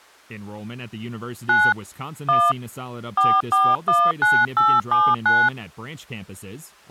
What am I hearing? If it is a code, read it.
DTMF, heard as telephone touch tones, dialled by hand, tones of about 230 ms. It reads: 9 1 4419879